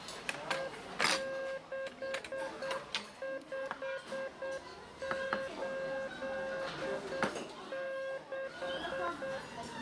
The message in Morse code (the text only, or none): E6586